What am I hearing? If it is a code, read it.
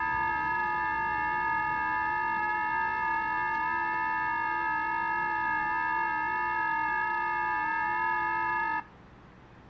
FT8 (several signals at once), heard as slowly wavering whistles, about 6.25 baud, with the noise of a residential street.